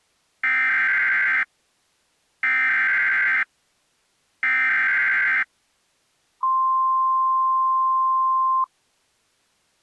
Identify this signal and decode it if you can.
Emergency Alert System (SAME) tones (header bursts, then the 1050 Hz attention tone), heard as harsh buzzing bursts, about 520.83 baud.